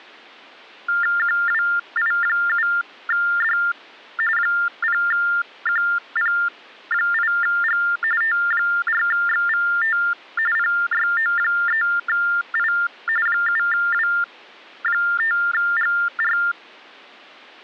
TTY/TDD text telephone tones (45.45 baud Baudot), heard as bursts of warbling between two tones, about 400 Hz shift, 1600 Hz centre. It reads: QWI7D 0QP8G T4XVT PYO3I 7W5GR